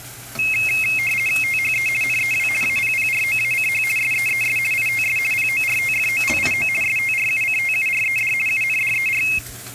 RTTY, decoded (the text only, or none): THE NEW APPROACH SEES ITS PORTFOLIO STRUCTURED UNDER